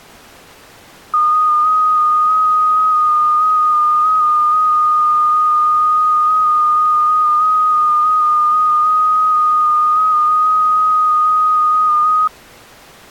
FT8 (one signal), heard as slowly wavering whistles, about 6.25 baud.